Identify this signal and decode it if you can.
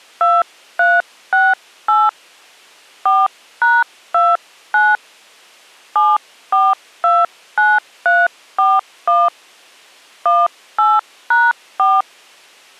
DTMF, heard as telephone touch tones, dialled by hand, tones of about 210 ms. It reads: 2368 4#29 7429341 18#4